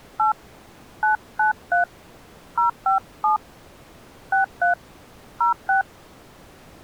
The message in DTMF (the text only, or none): 8 993 057 63 06